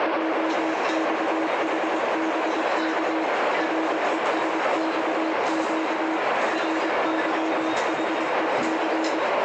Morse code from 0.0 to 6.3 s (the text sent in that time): JXHBK RESXQ